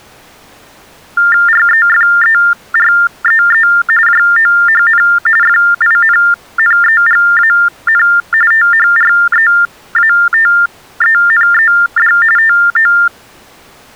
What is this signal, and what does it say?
TTY/TDD text telephone tones (45.45 baud Baudot), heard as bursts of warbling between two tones, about 400 Hz shift, 1600 Hz centre. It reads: REFEREE JOHN FINNEGAN THREATENED TO